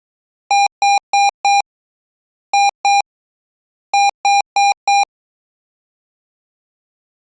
Beep code, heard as beeps from a small speaker, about 800 Hz. 4-2-4. In Phoenix BIOS tables: unexpected interrupt in protected mode.